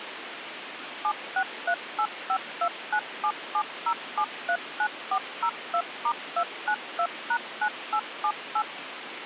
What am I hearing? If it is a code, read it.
DTMF, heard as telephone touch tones, dialled by machine, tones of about 70 ms, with phone line noise. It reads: 7638529770739402*292#9878